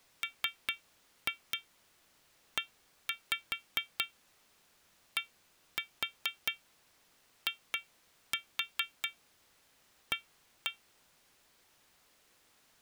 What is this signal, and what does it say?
Tap code, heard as taps on glass, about 4 knocks a second. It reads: MEDIA